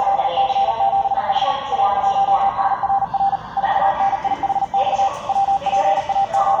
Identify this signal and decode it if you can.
Morse code, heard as a keyed tone, machine-sent, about 39 wpm, 790 Hz, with the noise of a subway station. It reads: … A1SRR 4NIHX …